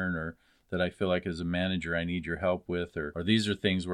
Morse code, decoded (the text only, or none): none